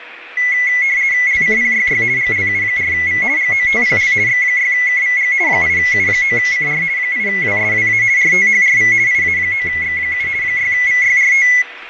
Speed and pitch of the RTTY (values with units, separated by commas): 50 baud, 170 Hz shift, 2050 Hz centre